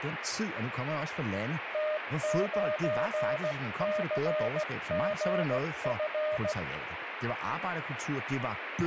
Morse code, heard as a keyed tone, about 16 wpm, 610 Hz, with radio static and speech in Danish. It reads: T9CGF